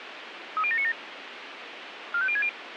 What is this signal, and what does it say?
Five-tone selective call (ZVEI), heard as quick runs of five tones, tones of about 70 ms, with radio hiss. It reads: 30797 45060